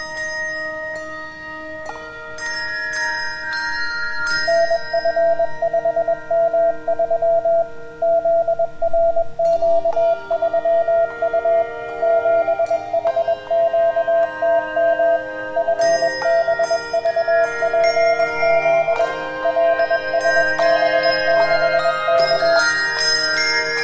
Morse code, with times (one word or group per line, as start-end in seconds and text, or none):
4.5-7.6 NF5M3
8.0-11.6 ZRQ3U
12.0-15.2 7HQTM
15.6-19.0 FBVPZ
19.4-22.6 LSB6K